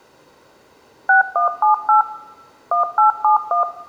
DTMF, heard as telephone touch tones, dialled by machine, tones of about 120 ms, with room echo. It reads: 6178 1871